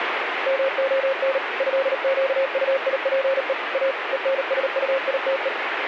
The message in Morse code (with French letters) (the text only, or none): MON ÉQUIPE A ENSUITE